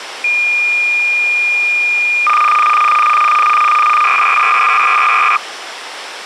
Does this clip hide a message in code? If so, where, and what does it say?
Yes: cassette data (Kansas City type), 300 baud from 0.2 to 5.4 s, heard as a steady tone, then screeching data, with tape hiss.